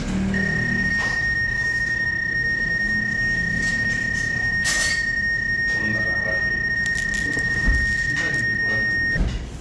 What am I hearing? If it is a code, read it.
PSK31 (31.25 baud), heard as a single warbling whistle, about 1850 Hz, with the noise of a restaurant.